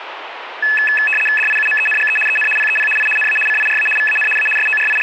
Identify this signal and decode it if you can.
RTTY (75 baud, 850 Hz shift), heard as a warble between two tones, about 2150 Hz centre, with radio static. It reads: DIUMENGE EN PEP I NA CIRA VAN A …